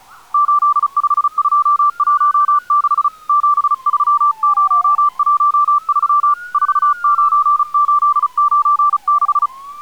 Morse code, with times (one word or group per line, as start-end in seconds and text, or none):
0.3-3.1 85216
3.3-6.3 73013
6.5-9.5 49896